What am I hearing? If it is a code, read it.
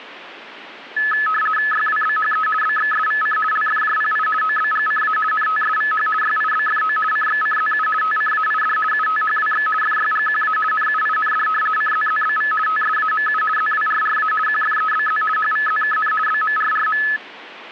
RTTY (50 baud, 450 Hz shift), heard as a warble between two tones, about 1500 Hz centre. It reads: YWBHE BXSVC LFJPI OBGCA NTSVH YIBFO CXCZU TCAID UTHWX FYGQA NUIND CZZBV TSAMU ZWRRA QFEBZ HVZKN BMRRM